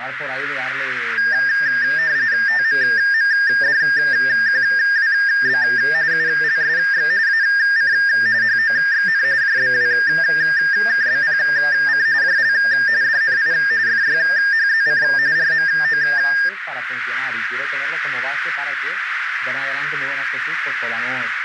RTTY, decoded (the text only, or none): TMMDQWB ULSX AC HOXN JBWKBPC JL DNI FYHZC RMO